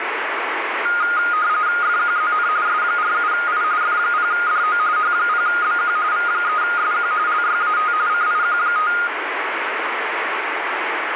RTTY (45.45 baud, 170 Hz shift), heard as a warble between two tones, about 1330 Hz centre, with radio static. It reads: FQZN S47I F0DO H0BQ V3SQ LYAT CIQ5